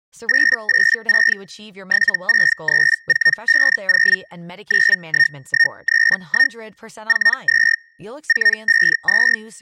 Hellschreiber (Feld-Hell, 122.5 baud), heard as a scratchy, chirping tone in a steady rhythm, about 1850 Hz, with speech in Swedish. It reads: 886 763450 91131 42 452